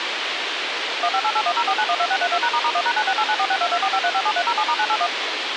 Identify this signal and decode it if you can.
DTMF, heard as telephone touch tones, dialled by machine, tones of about 60 ms, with radio hiss. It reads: 1588104912632#**1#9689462245357307*981